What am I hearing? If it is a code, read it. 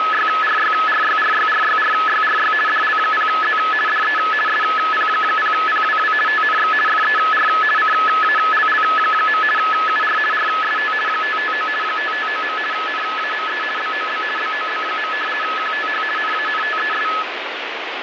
RTTY (50 baud, 450 Hz shift), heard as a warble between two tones, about 1500 Hz centre, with radio static. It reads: … DL0Z DE SP0PWW TNX FER CALL. UR RST 559 559. NAME BOB BOB. QTH NANTES